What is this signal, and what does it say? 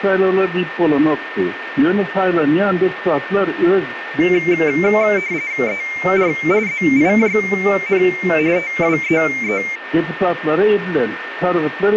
RTTY (45.45 baud, 170 Hz shift), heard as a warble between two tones, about 2200 Hz centre, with radio static and a steady whistle near 1810 Hz. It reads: ER ZIJN TWEE